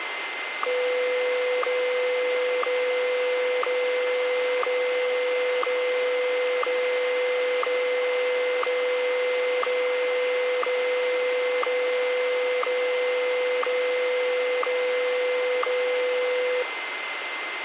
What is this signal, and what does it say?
Radio time signal (WWVH, Hawaii), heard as ticks, one a second, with radio static and a steady whistle near 2080 Hz.